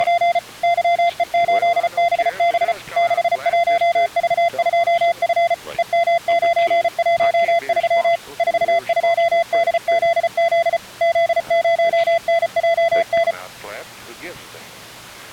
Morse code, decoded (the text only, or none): … YE8BB 61V2F EM913 42DZZ Z0NJN